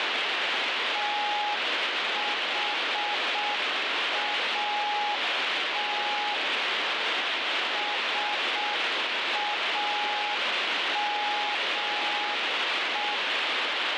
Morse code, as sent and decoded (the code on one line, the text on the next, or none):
- .... .- - / ... .- -- .
THAT SAME